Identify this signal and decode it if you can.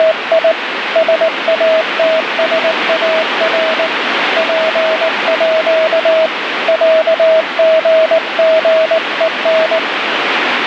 Morse code (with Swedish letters), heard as a keyed tone, hand-sent with a paddle, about 19 wpm, 640 Hz, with radio static. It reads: … SATSAR PÅ ÄGGEN